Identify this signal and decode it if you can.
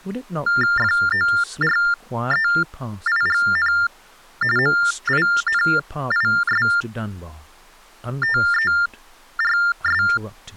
TTY/TDD text telephone tones (45.45 baud Baudot), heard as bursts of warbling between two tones, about 400 Hz shift, 1600 Hz centre, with speech in English. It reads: FOREIGN MINISTERS